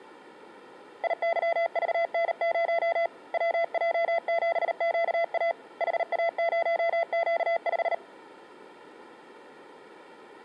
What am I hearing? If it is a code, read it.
Morse code, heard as a keyed tone, hand-sent with a paddle, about 38 wpm, 670 Hz. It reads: IYVN0 WJ7QA HA0Q5